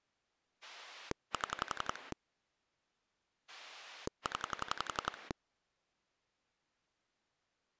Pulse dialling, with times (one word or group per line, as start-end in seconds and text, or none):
0.6-2.1 7
3.5-5.3 0